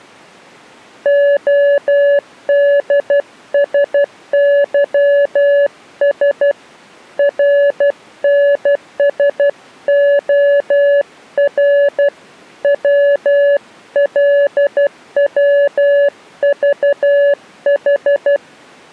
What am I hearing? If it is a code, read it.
Morse code, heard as a keyed tone, hand-sent with a paddle, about 12 wpm, 570 Hz. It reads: ODSYS RNSOR WLWVH